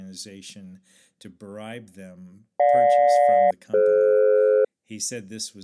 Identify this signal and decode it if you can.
Aircraft SELCAL, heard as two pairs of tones, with speech in English. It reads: GJ-DF